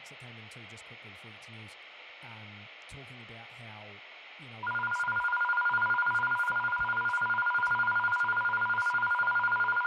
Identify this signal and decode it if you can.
A tone that alternates evenly between two pitches, with room echo and speech in English. There is no code.